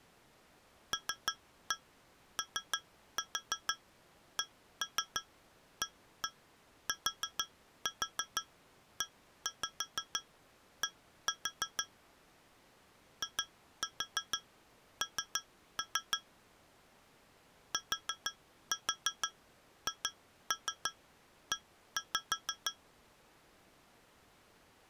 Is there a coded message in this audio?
Yes: tap code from 0.9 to 22.8 s, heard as taps on glass, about 6 knocks a second. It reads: LOCATED IN THE